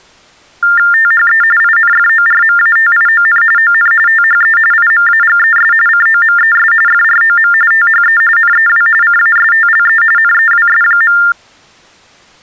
TTY/TDD text telephone tones (45.45 baud Baudot), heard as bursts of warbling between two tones, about 400 Hz shift, 1600 Hz centre. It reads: THE INFORMATION ON THE IMAGES COMES FROM THE NEW CASTLE NEWS.